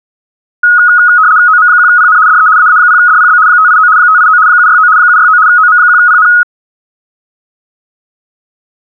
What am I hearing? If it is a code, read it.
RTTY (75 baud, 170 Hz shift), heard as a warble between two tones, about 1360 Hz centre. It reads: OM1PN DE AA0DPB 589 589 769 769 OM1PN